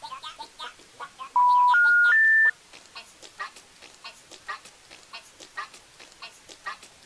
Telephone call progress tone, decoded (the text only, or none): special information tone